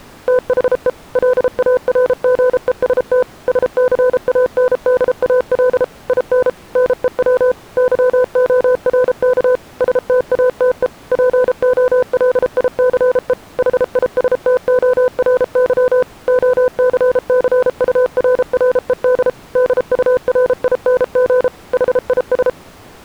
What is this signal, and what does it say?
Morse code, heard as a keyed tone, machine-sent, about 33 wpm, 500 Hz. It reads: THE LARGEST SCANDAL IN NEW YORK STATE POLICE HISTORY OCCURRED DURING HIS